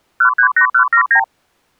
Multi-frequency trunk signalling (R2, with the far end's replies), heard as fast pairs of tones, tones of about 90 ms. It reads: 138179